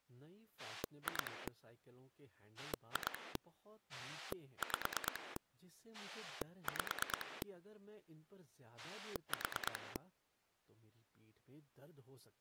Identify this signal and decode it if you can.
Pulse dialling, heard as a rotary dial, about 9 pulses a second, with speech in Hindi. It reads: 2 2 5 5 4